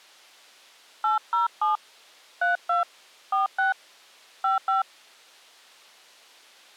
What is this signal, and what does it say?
DTMF, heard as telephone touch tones, dialled by hand, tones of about 140 ms. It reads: 807 32 46 55